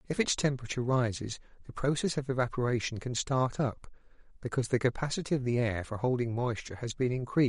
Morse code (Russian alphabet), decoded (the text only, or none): none